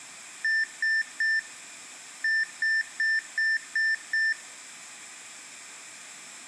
Beep code, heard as beeps, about 1800 Hz, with room echo. 3-6.